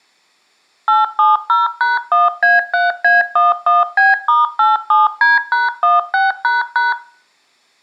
DTMF, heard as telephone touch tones, dialled by machine, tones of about 170 ms. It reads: 870#1A3A11B*87D#16##